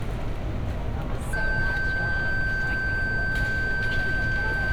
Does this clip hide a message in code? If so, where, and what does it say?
No, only a steady tone, with room echo and street noise.